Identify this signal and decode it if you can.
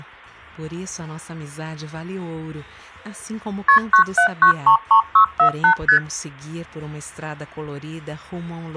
Multi-frequency trunk signalling (R1, as on North American trunks), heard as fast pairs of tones, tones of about 100 ms. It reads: KP 97933648 ST